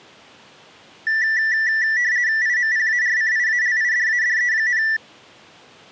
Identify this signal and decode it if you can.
RTTY (50 baud, 170 Hz shift), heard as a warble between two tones, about 1850 Hz centre. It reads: IMPARCIALIDADE,